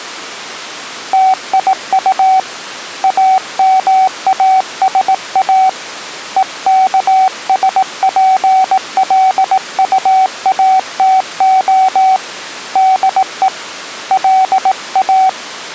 Morse code, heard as a keyed tone, hand-sent with a paddle, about 18 wpm, 760 Hz. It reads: TIU AMASA EKSPLUATO DE LA